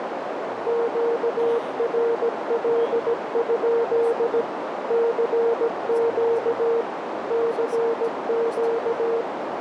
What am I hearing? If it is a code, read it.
Morse code, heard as a keyed tone, machine-sent, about 17 wpm, 460 Hz, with heavy radio static, a narrow filter and speech in Russian. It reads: QRL? CQ CQ